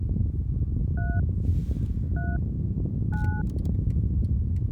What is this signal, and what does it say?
DTMF, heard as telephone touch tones, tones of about 210 ms, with the noise inside a car. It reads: 3 3 9